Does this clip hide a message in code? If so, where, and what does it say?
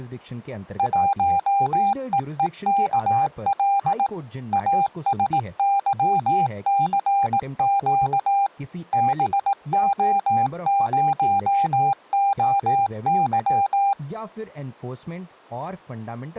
Yes: Morse code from 0.7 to 14.0 s, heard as a keyed tone, machine-sent, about 18 wpm, 800 Hz, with speech in Hindi. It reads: 1EEKL ASYCQ BO0OY